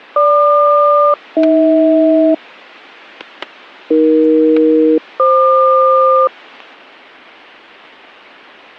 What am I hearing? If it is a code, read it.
Aircraft SELCAL, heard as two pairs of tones, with static crashes. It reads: GQ-AH AE-FQ